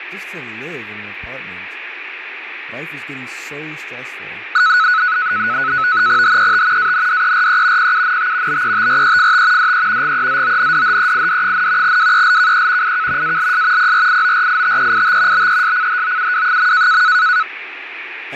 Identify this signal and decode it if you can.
NAVTEX (SITOR-B), 100 baud, 170 Hz shift, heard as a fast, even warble, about 1380 Hz centre, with radio static, fading and speech in English. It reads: HET ANDERE PUNT BETREFT DE GEZONDHEID, WELKE IK ALS PRIORITEIT BESCHOUW.